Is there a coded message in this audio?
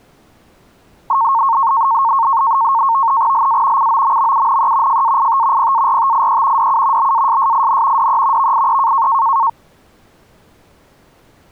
Yes: NAVTEX (SITOR-B), 100 baud, 170 Hz shift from 1.1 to 9.5 s, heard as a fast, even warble, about 1000 Hz centre. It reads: LA COMMUNE FAIT PARTIE DU BASSIN DE VIE